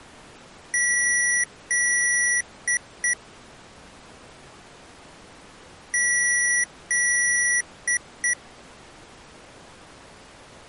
Beep code, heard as beeps from a small speaker, played twice, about 1950 Hz. 2 long, 2 short.